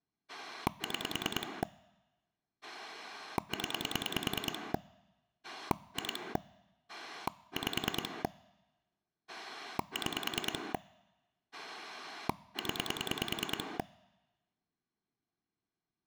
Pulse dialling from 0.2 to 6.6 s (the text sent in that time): 6 0 2